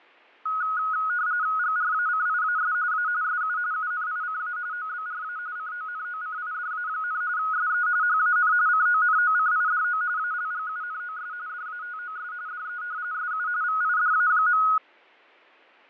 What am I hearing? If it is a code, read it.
RTTY (45.45 baud, 170 Hz shift), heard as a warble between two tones, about 1360 Hz centre, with fading. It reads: GRACIAS A SU UNICA OBRA CONOCIDA, SE HAN CONOCIDO ALGUNOS DATOS DE SU VIDA.